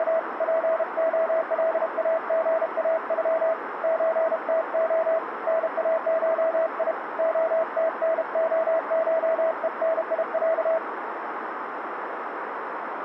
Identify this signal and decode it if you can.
Morse code (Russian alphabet), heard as a keyed tone, hand-sent with a paddle, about 32 wpm, 650 Hz, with radio static and a narrow filter. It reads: … ПОЛАГАЮ ЧТО НАШИ ОТНОШЕНИЯ